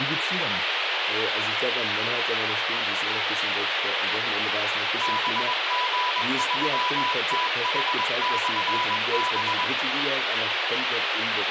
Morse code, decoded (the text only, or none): BG3TH/B